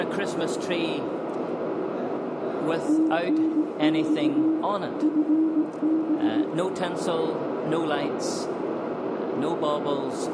Morse code, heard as a keyed tone, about 18 wpm, 320 Hz, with heavy radio static, a narrow filter and room echo. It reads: TNX FB